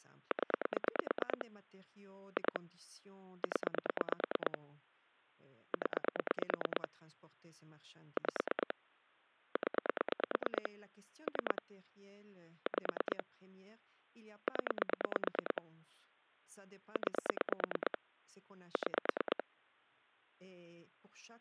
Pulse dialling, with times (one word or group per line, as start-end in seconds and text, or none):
0.3-1.4 0
2.4-2.6 2
3.4-4.6 0
5.7-6.9 0
8.2-8.7 5
9.6-10.7 0
11.3-11.6 3
12.7-13.2 5
14.5-15.6 0
17.0-18.0 9
18.8-19.4 6